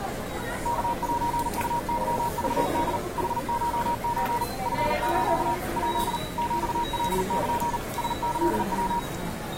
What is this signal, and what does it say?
Morse code (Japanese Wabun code), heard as a keyed tone, machine-sent, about 39 wpm, 950 Hz, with the noise of a subway station. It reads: ワセウケクホ ヌコソ チス ヱ ヒカル ラキヤ